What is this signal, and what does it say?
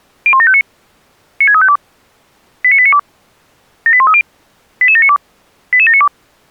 Five-tone selective call (ZVEI), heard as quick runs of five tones, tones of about 70 ms. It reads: 01759 96352 89892 78130 88792 88792